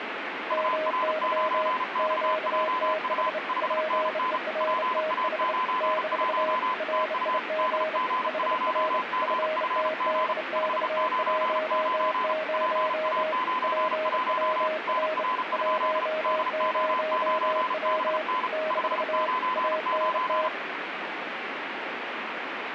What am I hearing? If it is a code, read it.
Morse code, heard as two keyed tones, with radio static. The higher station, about 35 wpm, 1020 Hz: UR9XJU 5NN PA91 TU DG1GFG 599 PA91 NR? DO9BN 599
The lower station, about 29 wpm, 630 Hz: MY QTH PERTH - RIG HR FTDX10 PWR 10W - ANT